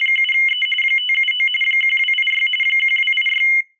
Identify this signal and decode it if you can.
RTTY (45.45 baud, 850 Hz shift), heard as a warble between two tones, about 2550 Hz centre. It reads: … 579 1286 1286